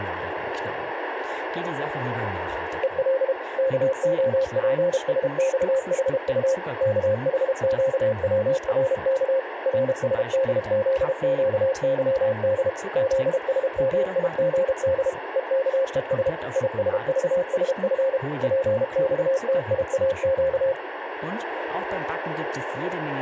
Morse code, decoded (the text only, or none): EL KOPSXHU KHQWRK RSDZQYD ZSMIGD EKES ISVSF PXTIAQ